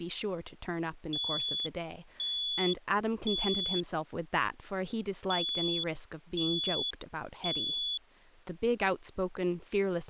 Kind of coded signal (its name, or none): alarm pattern